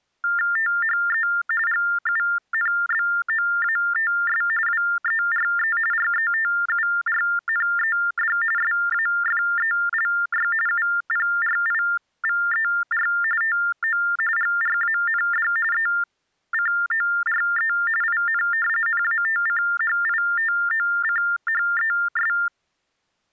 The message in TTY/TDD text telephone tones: THE GUNBOATS WERE RETURNED SAFELY UPRIVER TO GRAND ECORE IN NATCHITOCHES

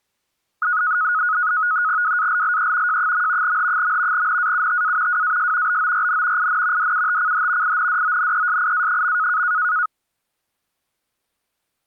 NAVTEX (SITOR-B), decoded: WALLE J. H. NAUTA WAS BORN IN DUTCH INDONESIA.

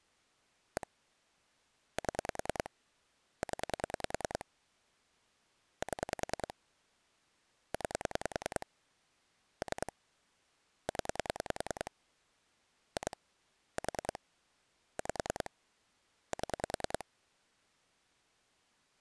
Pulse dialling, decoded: 1 7 0 7 9 3 0 2 4 5 7

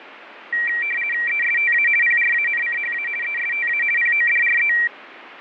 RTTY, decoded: ESTA PRANCHA ESTA PODRE

